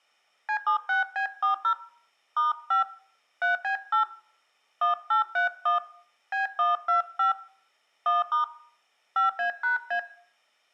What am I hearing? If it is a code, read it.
DTMF, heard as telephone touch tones, dialled by hand, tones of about 120 ms, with room echo. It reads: C76B40 *5 3B8 1831 B125 1* 5A#A